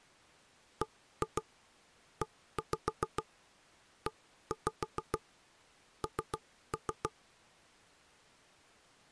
Tap code, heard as knocks on wood, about 7 knocks a second. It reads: BEEN